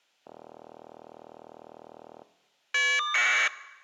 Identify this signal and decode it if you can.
Caller ID data burst, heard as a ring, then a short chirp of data, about 1200 baud.